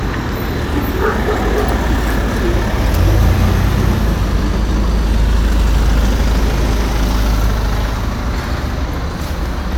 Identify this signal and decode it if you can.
The noise of a residential street. There is no code.